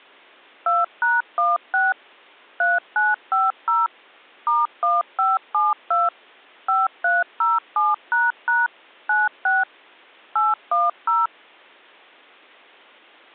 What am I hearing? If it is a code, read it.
DTMF, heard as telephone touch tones, dialled by machine, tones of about 180 ms. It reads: 2#16 3950 *1572 5307## 96 810